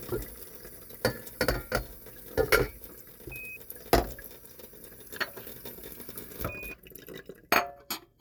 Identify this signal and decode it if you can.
Quindar tones, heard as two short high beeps, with kitchen noise.